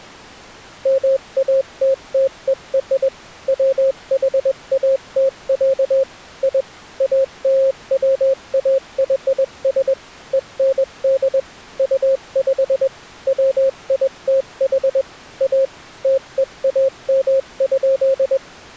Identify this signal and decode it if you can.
Morse code (American railroad code), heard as a keyed tone, machine-sent, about 540 Hz. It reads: MATTER WHAT, I ALWAYS END UP WITH A TEAM.